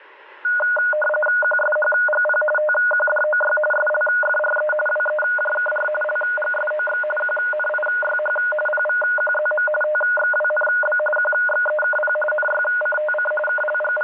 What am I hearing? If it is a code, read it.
RTTY (45.45 baud, 850 Hz shift), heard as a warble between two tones, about 1030 Hz centre, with radio static. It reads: QSHGP TQDOY SLFRE WEJKR LGSOX QNIYH PVQZM TXWNB QXEKP NYCTC …